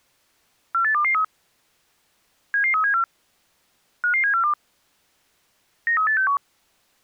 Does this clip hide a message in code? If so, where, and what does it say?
Yes: five-tone selective call (CCIR) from 0.7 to 6.4 s, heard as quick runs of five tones, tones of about 100 ms. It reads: 48223 77374 55742 93861